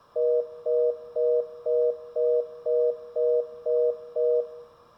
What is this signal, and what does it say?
Telephone call progress tone (North American plan), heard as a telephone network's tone, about 480, 620 Hz, 0.25 s on and 0.25 s off, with room echo. Congestion tone.